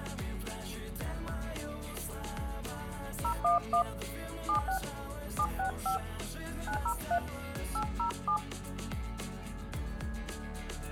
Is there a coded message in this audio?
Yes: DTMF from 3.2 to 8.4 s, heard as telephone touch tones, dialled by hand, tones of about 100 ms. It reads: 011 76 765 903 807